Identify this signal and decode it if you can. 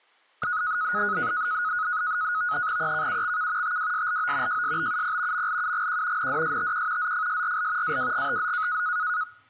NAVTEX (SITOR-B), 100 baud, 170 Hz shift, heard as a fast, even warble, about 1360 Hz centre. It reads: EKUXK TWSLO JSBUP MLUGQ NDSTQ ZFSRL AWGTZ